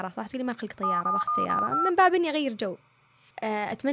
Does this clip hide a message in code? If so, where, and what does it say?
Yes: DTMF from 0.8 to 1.9 s, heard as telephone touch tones, dialled by machine, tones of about 180 ms, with speech in Arabic. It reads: 77115